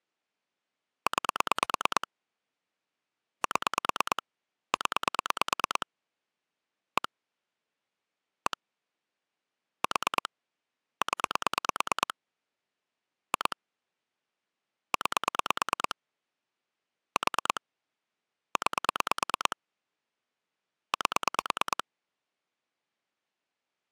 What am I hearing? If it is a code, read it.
Pulse dialling, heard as clicks on a phone line, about 9 pulses a second. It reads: 9 7 0 1 1 4 0 2 9 4 9 8